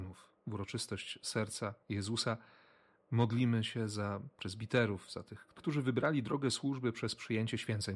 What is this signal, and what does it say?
Speech in Polish. There is no code.